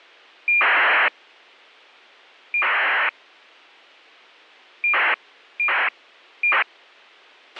ACARS aircraft data, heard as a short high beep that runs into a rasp, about 2400 baud, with a squelch burst at the end.